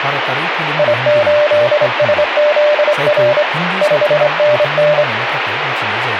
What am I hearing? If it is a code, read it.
Morse code, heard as a keyed tone, hand-sent with a straight key, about 25 wpm, 600 Hz, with radio static and speech in Bodo. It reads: I8SZR 5NN